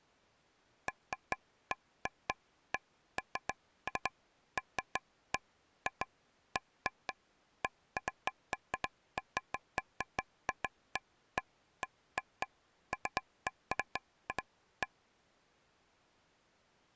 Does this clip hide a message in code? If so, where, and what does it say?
No, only irregular taps on a table.